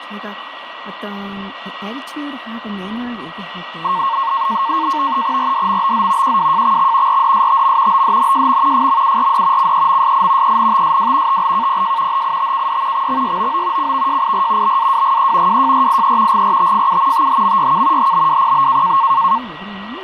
NAVTEX (SITOR-B), 100 baud, 170 Hz shift, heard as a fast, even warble, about 1000 Hz centre, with radio static, a steady whistle near 1920 Hz and speech in Korean. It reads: RDMBZ QWJXX RDSTM BDNJM FMURD CEMSI ENTSW TLKPJ HITKD XXYOO CVJIR BAWGE WJRIE GRTFU THMYK HBWPB